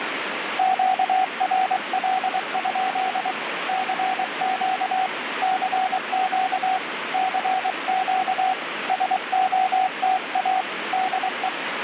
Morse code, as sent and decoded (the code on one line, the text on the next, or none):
--.- .-. .-.. ..--.. / -.-. --.- / -.-. --.- / -.-. --.- / ... --- - .- / -.. .
QRL? CQ CQ CQ SOTA DE